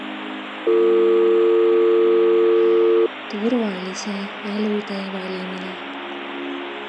Telephone call progress tone (North American or UK plan), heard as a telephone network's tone, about 350, 450 Hz. Dial tone.